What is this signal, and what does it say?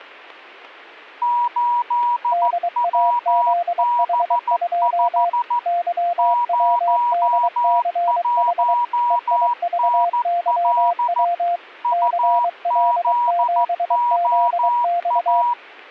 Morse code, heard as two keyed tones. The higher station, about 14 wpm, 960 Hz: 8WB5 01NL UZOA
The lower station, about 23 wpm, 700 Hz: DAZH2 YWDCH EIVYW CL7ZX